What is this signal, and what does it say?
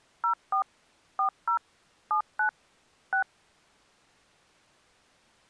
DTMF, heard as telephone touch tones, dialled by machine, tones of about 100 ms. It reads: 04 40 79 6